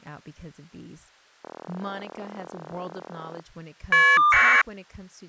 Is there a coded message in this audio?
Yes: caller ID data burst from 1.4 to 4.6 s, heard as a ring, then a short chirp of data, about 1200 baud, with speech in English.